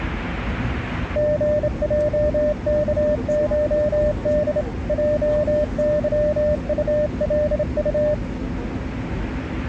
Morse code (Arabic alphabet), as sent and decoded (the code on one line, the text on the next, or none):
--. .--- -.- ---- -.. / .--- -.-- ..- .-.. ..-
غجكشد جظطلط